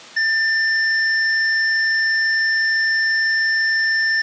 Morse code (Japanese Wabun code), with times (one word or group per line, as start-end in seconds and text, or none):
none